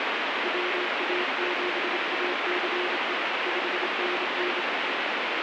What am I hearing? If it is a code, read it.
Morse code, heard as a keyed tone, hand-sent with a bug key, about 27 wpm, 360 Hz, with heavy radio static. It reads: WA7ACE 5NN